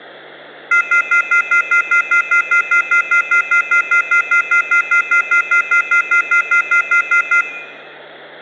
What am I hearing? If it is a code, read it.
Telephone call progress tone (North American plan), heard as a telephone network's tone, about 1400, 2050, 2450, 2600 Hz, 0.1 s on and 0.1 s off, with hum. Off-hook warning tone.